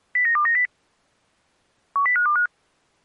Five-tone selective call (CCIR), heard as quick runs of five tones, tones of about 100 ms. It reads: 09290 10525